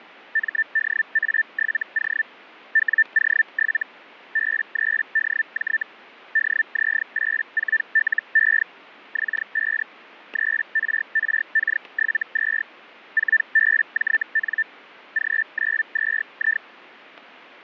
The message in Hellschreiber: MDA7O WO7 B3DJ DZ84LE X5 3RRK72 4BJN G92I

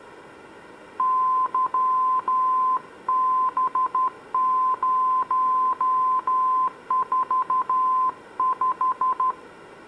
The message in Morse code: YB045

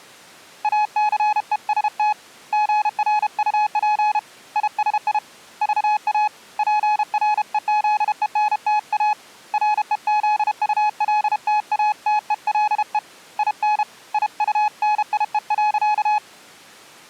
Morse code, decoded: ACEST GRUP ISI VA PREZENTA REZULTATELE IN IUNIE.

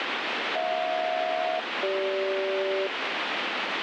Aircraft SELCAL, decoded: HJ-CG

